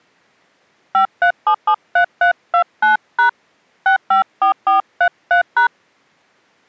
DTMF, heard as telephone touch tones, dialled by hand, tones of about 100 ms. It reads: 53773329# 654433#